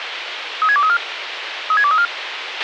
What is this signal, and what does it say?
Five-tone selective call (ZVEI), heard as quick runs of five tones, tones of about 70 ms, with radio hiss and a squelch burst at the end. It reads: 36234 36234